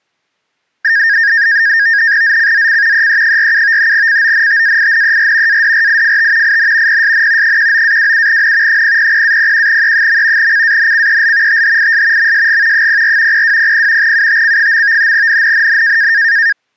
NAVTEX (SITOR-B), 100 baud, 170 Hz shift, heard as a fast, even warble, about 1750 Hz centre. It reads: ZCZC EE47 CONTAINER ADRIFT IN PSN 19-27N 000-01E. CANCEL THIS MSG 04 0200 UTC. NNNN